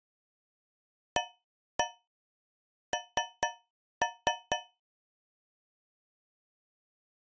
Tap code, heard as taps on a metal pipe, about 4 knocks a second. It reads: AN